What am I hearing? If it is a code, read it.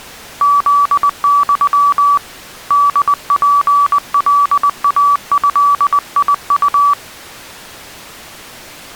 Morse code (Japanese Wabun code), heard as a keyed tone, hand-sent with a paddle, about 20 wpm, 1150 Hz. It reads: フユ ホツカイドウ